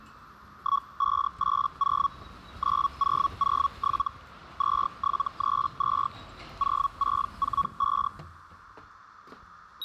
Hellschreiber (Feld-Hell, 122.5 baud), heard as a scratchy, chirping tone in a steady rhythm, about 1120 Hz, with street noise. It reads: 1580 9007 2732 0645